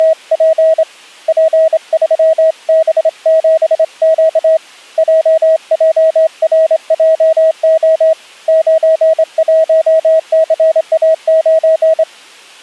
Morse code, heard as a keyed tone, hand-sent with a straight key, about 25 wpm, 640 Hz. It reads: … P3B7Q JJRJO 91CA9